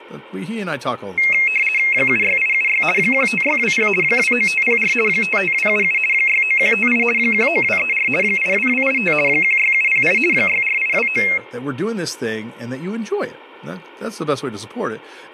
RTTY (50 baud, 450 Hz shift), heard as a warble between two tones, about 2350 Hz centre, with speech in English. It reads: 76876 15620 29504 55277 69158 19234 82285 16708 64829